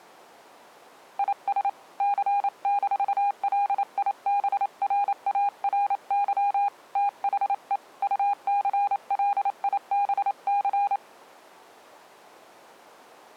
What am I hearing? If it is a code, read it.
Morse code, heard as a keyed tone, hand-sent with a paddle, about 28 wpm, 810 Hz. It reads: IS C-LIBRARY THE UCLIBC